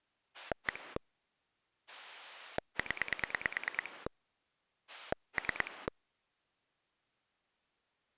Pulse dialling, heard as a rotary dial, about 9 pulses a second. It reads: 1 0 3